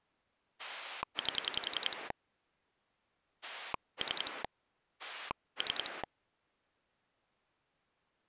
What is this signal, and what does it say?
Pulse dialling, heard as a rotary dial, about 10 pulses a second. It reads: 8 3 3